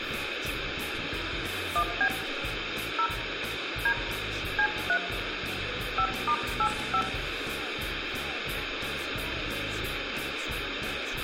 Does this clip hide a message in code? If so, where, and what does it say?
Yes: DTMF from 1.8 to 7.0 s, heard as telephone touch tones, dialled by hand, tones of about 70 ms, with radio hiss and room echo. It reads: 1B 0 D C3 5*85